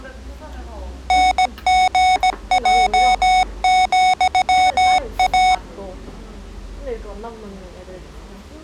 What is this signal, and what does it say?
Morse code, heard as electronic beeps, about 17 wpm, 740 Hz, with the noise of a restaurant. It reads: NGJ,A